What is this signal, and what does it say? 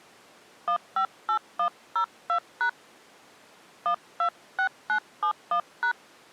DTMF, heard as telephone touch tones, dialled by hand, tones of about 90 ms. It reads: 158102# 126971#